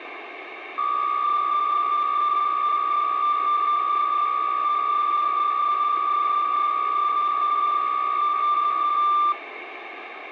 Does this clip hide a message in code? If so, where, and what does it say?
Yes: PSK63 (62.5 baud) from 0.8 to 9.3 s, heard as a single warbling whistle, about 1190 Hz, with radio static.